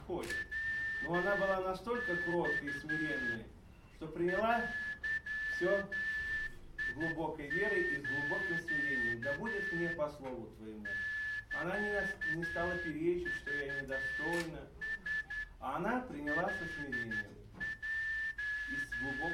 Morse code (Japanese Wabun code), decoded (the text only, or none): ヤマ デス サクラ …